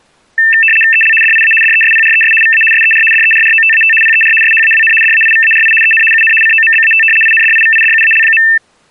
RTTY (75 baud, 850 Hz shift), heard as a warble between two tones, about 2250 Hz centre. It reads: EL DIA DESPRES VA SER DERROTAT PER SHAWN DAIVARI EN UN COMBAT INDIVIDUAL.